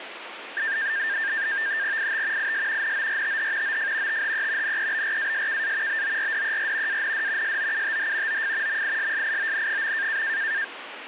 NAVTEX (SITOR-B), 100 baud, 170 Hz shift, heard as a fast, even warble, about 1700 Hz centre, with radio static. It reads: IT IS NORTH OF THE NEBRASKA BORDER AND SOUTH OF MISSION.